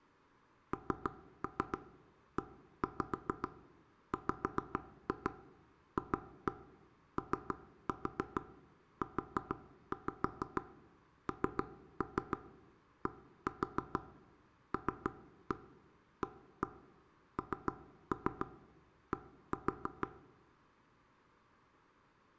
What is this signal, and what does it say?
Tap code, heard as taps on a table, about 6 knocks a second, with room echo. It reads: NEWFOUNDLAND